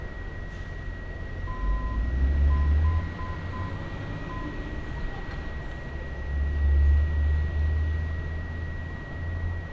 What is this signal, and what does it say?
Morse code, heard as a keyed tone, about 7 wpm, 1020 Hz, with room echo and street noise. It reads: THE